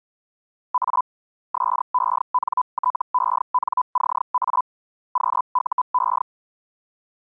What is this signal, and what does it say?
Hellschreiber (Feld-Hell, 122.5 baud), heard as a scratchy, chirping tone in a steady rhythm, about 1000 Hz. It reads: A SENTENCA QUE